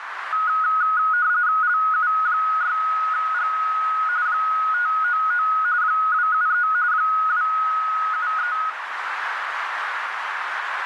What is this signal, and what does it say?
RTTY (45.45 baud, 170 Hz shift), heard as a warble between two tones, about 1360 Hz centre, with radio static and a narrow filter. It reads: LU6G 599 273 273